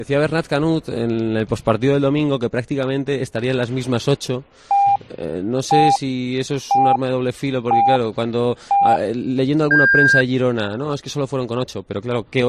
Radio time signal (five pips and a higher one, as on Chinese radio), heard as pips.